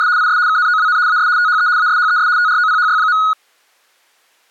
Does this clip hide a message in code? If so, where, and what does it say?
Yes: RTTY (75 baud, 170 Hz shift) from 0.0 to 3.3 s, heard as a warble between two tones, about 1360 Hz centre. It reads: … IS KNOWN AS THE ASHES TROPHY.